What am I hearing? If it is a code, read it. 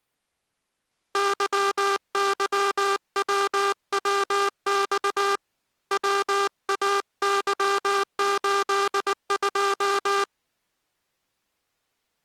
Morse code, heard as a buzzer, hand-sent with a paddle, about 19 wpm. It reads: YYWWX WAY82